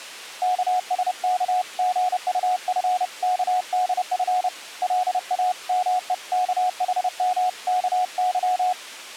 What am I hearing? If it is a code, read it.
Morse code (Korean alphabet), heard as a keyed tone, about 30 wpm, 730 Hz. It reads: 영신은 고마움에